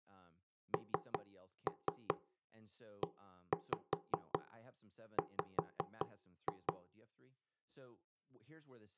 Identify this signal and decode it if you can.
Tap code, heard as knocks on wood, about 5 knocks a second, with speech in English. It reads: NEW